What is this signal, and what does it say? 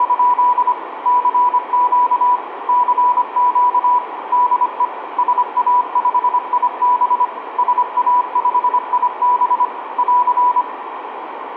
Morse code, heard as a keyed tone, machine-sent, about 25 wpm, 980 Hz, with radio static and room echo. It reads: … CQ CQ DE SA5IB SA5IB <AR>